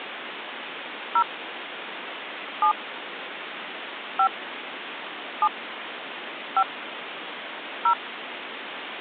DTMF, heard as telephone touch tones, dialled by hand, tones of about 80 ms, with phone line noise. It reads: 0 7 5 7 5 0